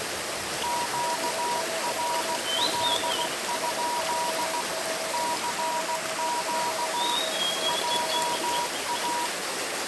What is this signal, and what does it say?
Morse code, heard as two keyed tones, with radio static and the noise of a park. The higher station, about 16 wpm, 960 Hz: QRL? CQ JA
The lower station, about 33 wpm, 650 Hz: OM3IEJ 599 02 NR?